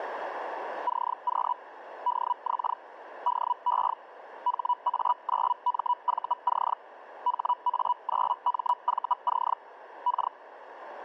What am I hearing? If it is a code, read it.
Hellschreiber (Feld-Hell, 122.5 baud), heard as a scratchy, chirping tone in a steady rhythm, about 980 Hz, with radio static and a narrow filter. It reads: CQ DX DE HA9MVC HA9MVC K